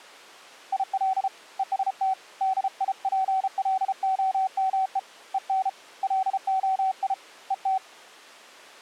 Morse code, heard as a keyed tone, hand-sent with a paddle, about 33 wpm, 760 Hz. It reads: IL EST DIPLOME EN LOI ET